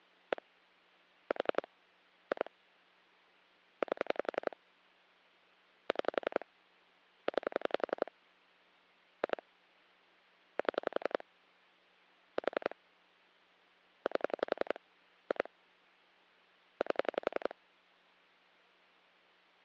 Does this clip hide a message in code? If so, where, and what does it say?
Yes: pulse dialling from 0.3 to 17.5 s, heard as clicks on a phone line, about 11 pulses a second. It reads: 1 4 2 8 6 9 2 7 4 8 2 8